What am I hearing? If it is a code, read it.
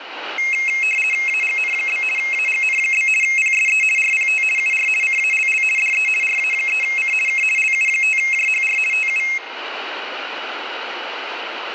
RTTY (50 baud, 450 Hz shift), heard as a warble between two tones, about 2350 Hz centre, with radio static and room echo. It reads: AGN? AGN? PSE RPT UR CALL DE RA3C K LU5JHR TU